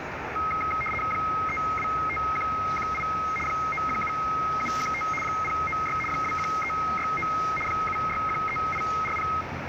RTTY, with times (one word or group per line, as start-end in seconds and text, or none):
1.1-3.0 325118
3.5-5.0 917715
5.2-6.0 096
6.1-7.3 21369
7.7-9.3 7613840